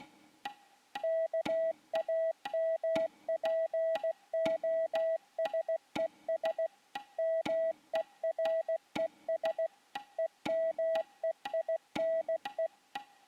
Morse code (Greek alphabet), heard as a keyed tone, machine-sent, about 16 wpm, 650 Hz. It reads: ΚΑΜΠΟΣΕΣ ΜΕΡΕΣ ΕΜΕΙΝΕ